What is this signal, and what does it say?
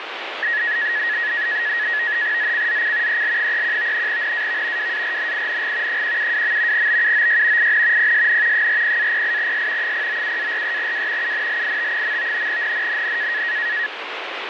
NAVTEX (SITOR-B), 100 baud, 170 Hz shift, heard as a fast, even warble, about 1800 Hz centre, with radio static. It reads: ZCZC EL31 NAV WARNING 172. BUOY IN PSN 40-08S 097-43W UNLIT. NNNN